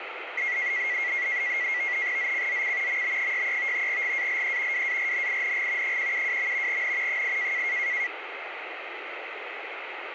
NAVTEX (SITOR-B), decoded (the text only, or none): ZCZC MB63 GALE WARNING 172. N 8